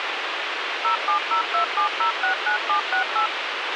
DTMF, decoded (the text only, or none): 07027069768